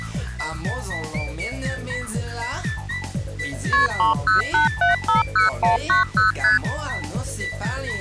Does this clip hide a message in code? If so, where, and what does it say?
Yes: multi-frequency trunk signalling (R1, as on North American trunks) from 3.7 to 6.6 s, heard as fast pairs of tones, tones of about 140 ms. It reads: KP 308750190 ST